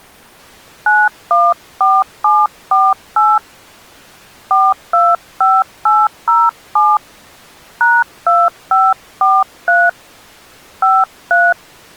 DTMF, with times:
0.9-3.4 914748
4.5-7.0 425807
7.8-9.9 #2543
10.8-11.5 53

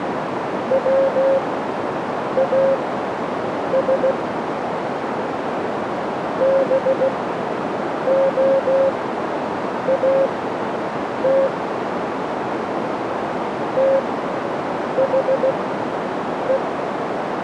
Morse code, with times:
0.7-4.1 WAS
6.4-11.5 BOAT
13.8-16.6 THE

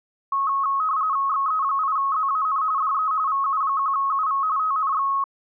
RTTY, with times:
1.3-2.6 XE8ZAN
2.8-3.1 DE
3.3-4.4 VU1UV
4.6-5.1 TNX

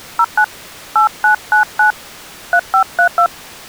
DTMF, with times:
0.2-0.4 09
1.0-1.9 8999
2.5-3.3 3532

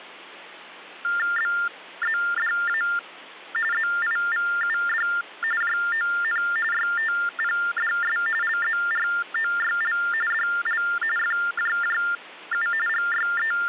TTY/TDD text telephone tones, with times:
1.4-2.8 BZDA
3.7-5.1 ZIVUD
5.6-6.4 JON
6.7-8.2 YTPDS
8.4-10.0 LZROYL
10.3-10.8 DL
11.2-12.7 FJJU
12.9-13.7 …

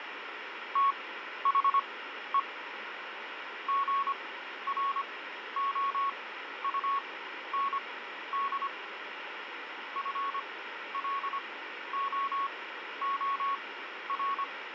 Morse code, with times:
0.8-2.4 THE
3.7-8.7 GROUND
10.0-14.4 FLOOR

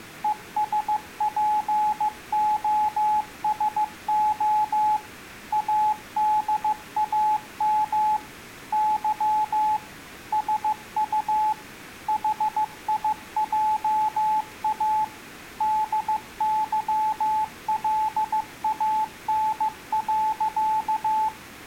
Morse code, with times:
0.2-5.0 ESPOSO
5.5-8.2 ADAM
8.7-9.8 Y
10.3-11.5 SU
12.1-15.0 HIJA
15.6-21.3 DYLAN.

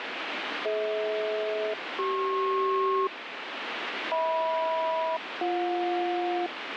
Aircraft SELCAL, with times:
0.7-3.1 DH-CP
4.1-6.5 HM-BJ

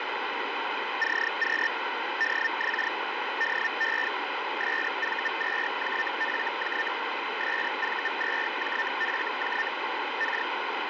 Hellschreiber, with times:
1.0-1.7 CQ
2.2-2.9 DX
3.4-4.1 DE
4.6-6.9 SV2JFJ
7.4-9.7 SV2JFJ
10.2-10.5 K

